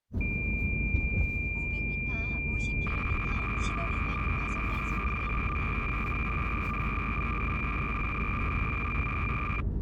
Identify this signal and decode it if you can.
Cassette data (Kansas City type), 300 baud, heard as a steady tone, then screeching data, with the noise inside a car.